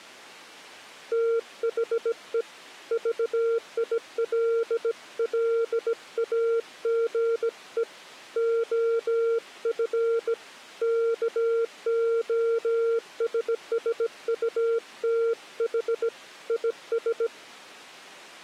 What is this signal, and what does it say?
Morse code, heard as a keyed tone, hand-sent with a bug key, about 17 wpm, 460 Hz. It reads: THE VILLAGE OF KOSSUTH IS